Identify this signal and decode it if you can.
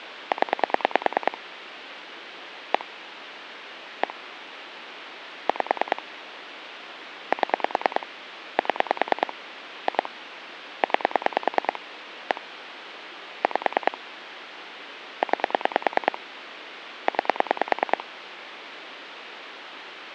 Pulse dialling, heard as clicks on a phone line, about 9 pulses a second, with phone line noise. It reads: 0 1 1 5 7 7 2 9 1 5 9 9